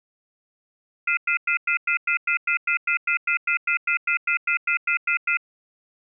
Telephone call progress tone (North American plan), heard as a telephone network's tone, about 1400, 2050, 2450, 2600 Hz, 0.1 s on and 0.1 s off. Off-hook warning tone.